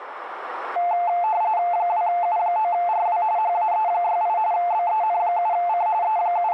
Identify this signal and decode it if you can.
RTTY (45.45 baud, 170 Hz shift), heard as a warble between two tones, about 790 Hz centre, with radio static. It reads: 2U9RW HAE68 BEN7C …